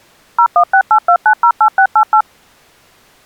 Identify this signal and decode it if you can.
DTMF, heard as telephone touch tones, dialled by machine, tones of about 80 ms. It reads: 01682908688